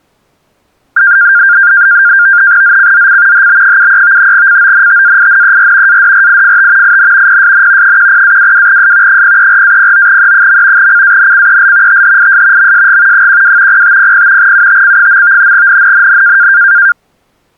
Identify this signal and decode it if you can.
NAVTEX (SITOR-B), 100 baud, 170 Hz shift, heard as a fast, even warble, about 1500 Hz centre. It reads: ZCZC HB73 CONTAINER ADRIFT IN PSN 10-22S 034-09E. CANCEL THIS MSG 12 0500 UTC. NNNN